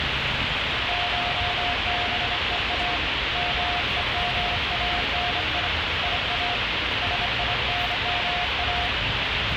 Morse code (Persian alphabet), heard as a keyed tone, hand-sent with a straight key, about 26 wpm, 710 Hz, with heavy radio static and street noise. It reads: شبها مهمانی یا سینما